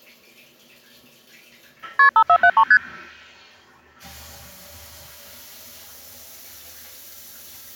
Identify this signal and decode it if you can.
Multi-frequency trunk signalling (R1, as on North American trunks), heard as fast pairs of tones, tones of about 70 ms, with the noise of a restroom. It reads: KP 5473 ST